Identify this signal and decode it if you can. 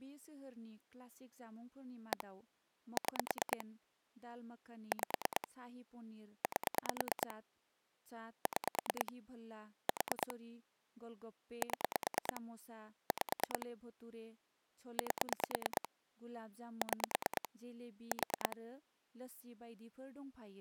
Pulse dialling, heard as clicks on a phone line, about 9 pulses a second, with speech in Bodo. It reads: 1 6 5 8 6 4 7 5 8 6 4